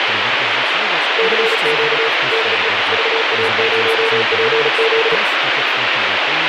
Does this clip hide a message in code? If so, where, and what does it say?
Yes: Morse code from 1.1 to 5.2 s, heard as a keyed tone, machine-sent, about 36 wpm, 450 Hz, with heavy radio static and speech in Polish. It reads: CQ DE VA0PZ